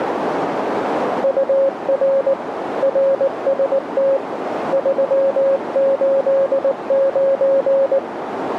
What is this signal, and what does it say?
Morse code, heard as a keyed tone, hand-sent with a paddle, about 19 wpm, 540 Hz, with radio static and a narrow filter. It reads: UR RST 389